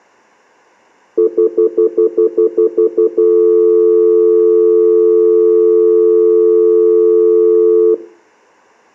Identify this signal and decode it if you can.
Telephone call progress tone (North American plan), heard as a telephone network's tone, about 350, 440 Hz, 0.1 s on and 0.1 s off, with room echo. Stutter dial tone.